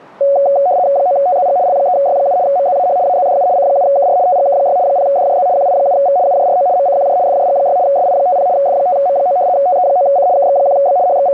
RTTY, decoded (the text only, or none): 9TZG L3Y7 MZAH AZDU C7KR TGK6 0DJZ QI7V UJRO MCQJ FJG6 SI50 F5M9 TE9C KX1B …